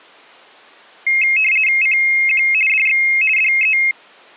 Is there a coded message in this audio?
Yes: RTTY (50 baud, 450 Hz shift) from 1.1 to 3.9 s, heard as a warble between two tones, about 2350 Hz centre. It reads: CQ DX DE